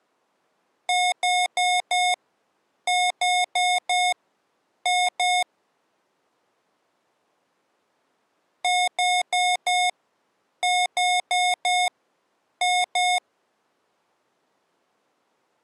Beep code, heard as beeps from a small speaker, played twice, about 720 Hz. 4-4-2. In Phoenix BIOS tables: parallel port failure.